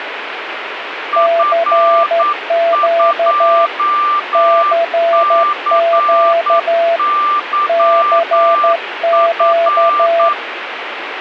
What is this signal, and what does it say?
Morse code, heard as two keyed tones, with radio static. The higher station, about 9 wpm, 1180 Hz: F2CYF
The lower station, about 12 wpm, 670 Hz: CQ CQ CQ